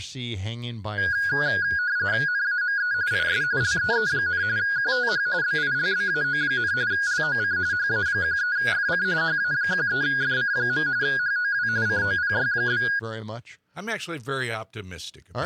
RTTY (45.45 baud, 170 Hz shift), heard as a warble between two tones, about 1550 Hz centre. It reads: NAME IS LEE, QTH BILBAO, LOC HA13FC HA13FC. HOW COPY?